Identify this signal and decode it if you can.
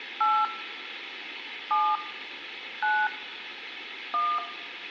DTMF, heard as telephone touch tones, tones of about 240 ms, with phone line noise and room echo. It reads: 8 7 9 1